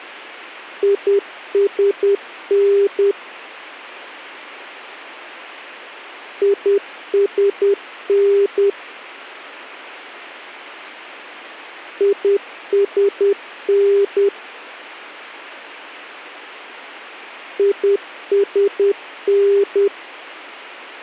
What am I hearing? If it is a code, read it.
Morse code, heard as a keyed tone, machine-sent, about 10 wpm, 400 Hz. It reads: ISN ISN ISN ISN